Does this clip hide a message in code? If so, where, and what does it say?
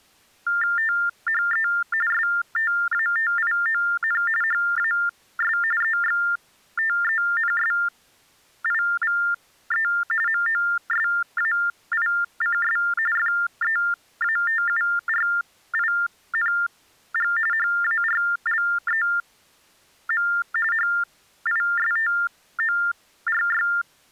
Yes: TTY/TDD text telephone tones (45.45 baud Baudot) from 0.5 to 23.8 s, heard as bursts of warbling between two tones, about 400 Hz shift, 1600 Hz centre. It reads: THE STATION HAS EXTENSIVE MOSAICS FEATURING HARLEM HISTORY